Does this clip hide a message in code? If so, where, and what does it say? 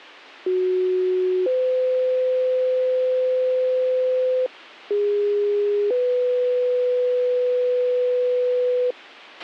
Yes: two-tone page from 0.5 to 8.9 s, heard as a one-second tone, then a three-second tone, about 370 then 510 Hz, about 410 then 500 Hz, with a squelch burst at the end.